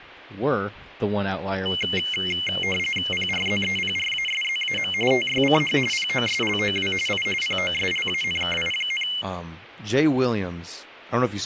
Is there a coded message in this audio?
Yes: RTTY (45.45 baud, 850 Hz shift) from 1.7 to 9.2 s, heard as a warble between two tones, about 2550 Hz centre, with speech in English. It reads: PRZEPRASZAM TYCH POSLOW I POSLANKI,